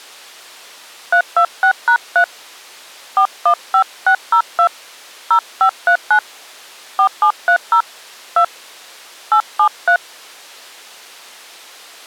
DTMF, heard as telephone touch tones, dialled by hand, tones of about 80 ms. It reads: 326#3 415602 0539 4730 2 873